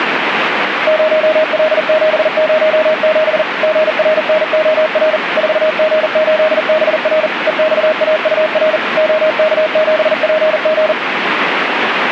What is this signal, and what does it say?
Morse code, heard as a keyed tone, machine-sent, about 40 wpm, 620 Hz, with radio static. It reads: 0L707 GRNOR 4G8BR EXAUR OK7PG